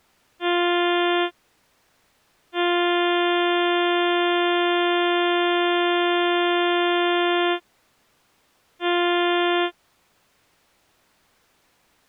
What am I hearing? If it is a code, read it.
Ship horn signal, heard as a ship's horn, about 350 Hz. 1 short, 1 long, 1 short. At sea: a vessel at anchor warns of its position.